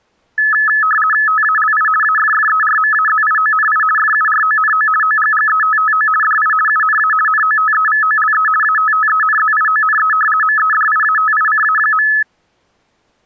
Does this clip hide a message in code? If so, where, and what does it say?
Yes: RTTY (50 baud, 450 Hz shift) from 0.4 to 12.2 s, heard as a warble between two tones, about 1500 Hz centre. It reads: TALI AFFERMAZIONI FURONO OGGETTO DI UNA NOTEVOLE ATTENZIONE MEDIATICA.